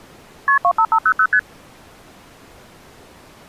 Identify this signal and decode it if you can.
Multi-frequency trunk signalling (R1, as on North American trunks), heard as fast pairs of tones, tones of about 70 ms. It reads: KP 25500 ST